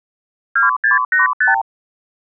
Multi-frequency trunk signalling (R2, with the far end's replies), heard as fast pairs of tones, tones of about 140 ms. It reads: 2685